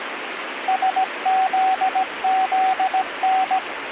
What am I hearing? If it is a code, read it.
Morse code, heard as a keyed tone, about 17 wpm, 760 Hz, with radio static. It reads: SZZN